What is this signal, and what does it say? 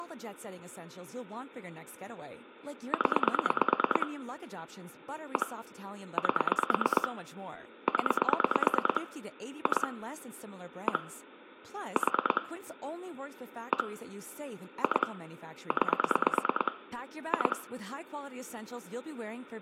Pulse dialling, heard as clicks on a phone line, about 9 pulses a second, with room echo and speech in English. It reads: 0 1 8 0 2 1 4 1 2 9 2